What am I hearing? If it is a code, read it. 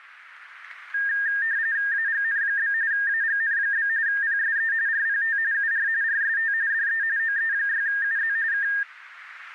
RTTY (45.45 baud, 170 Hz shift), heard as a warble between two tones, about 1700 Hz centre, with radio static. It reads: AGN? AGN? PSE RPT UR RST DE OE6UZ K